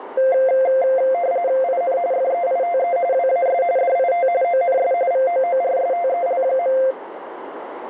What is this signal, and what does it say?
RTTY (45.45 baud, 170 Hz shift), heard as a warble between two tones, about 610 Hz centre, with radio static and a narrow filter. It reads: IN FEITE WAS DIT ONS VOORSTEL.